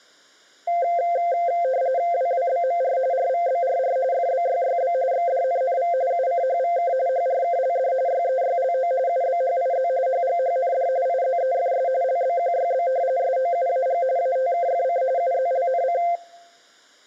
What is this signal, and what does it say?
RTTY (45.45 baud, 170 Hz shift), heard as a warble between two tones, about 610 Hz centre. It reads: WWBMR RVBRR FBYYB XDNNV UCHVK HRKLD YEYLO UBHIZ HGHND IZEFS LBQYB SOUAG ATKFC UZLNC